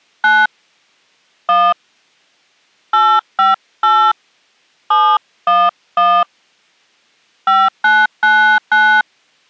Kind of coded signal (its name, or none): DTMF